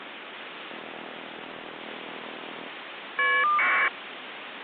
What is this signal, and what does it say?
Caller ID data burst, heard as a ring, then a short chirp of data, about 1200 baud, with phone line noise.